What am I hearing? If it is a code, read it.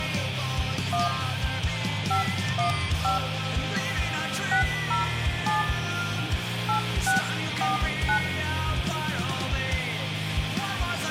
DTMF, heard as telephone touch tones, dialled by hand, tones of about 130 ms, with phone line noise and room echo. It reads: 1 515 607 8649